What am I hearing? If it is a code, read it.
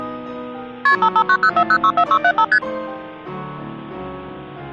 Multi-frequency trunk signalling (R1, as on North American trunks), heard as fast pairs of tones, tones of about 70 ms. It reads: KP 55904064675 ST